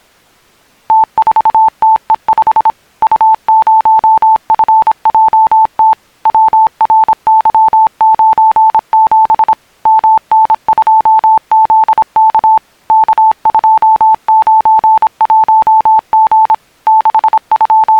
Morse code, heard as a keyed tone, machine-sent, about 26 wpm, 880 Hz. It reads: T4TE5 U0FJT WRY97 MN2ZK K291G …